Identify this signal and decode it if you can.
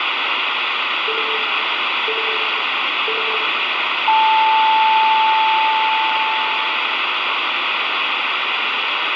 Radio time signal (three low pips and a long one an octave up, as on NHK), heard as pips, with radio static and room echo.